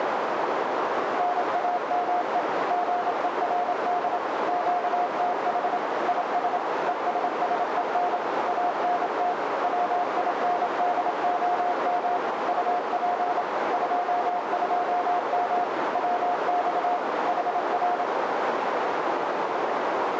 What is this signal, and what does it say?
Morse code, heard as a keyed tone, machine-sent, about 27 wpm, 710 Hz, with heavy radio static and a narrow filter. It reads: NAME GERD QTH IS ESSEN ANT WINDOM UP 22M WX HR